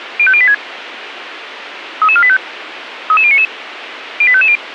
Five-tone selective call (ZVEI), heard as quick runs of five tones, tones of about 70 ms, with radio hiss. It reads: 05086 33485 33099 08550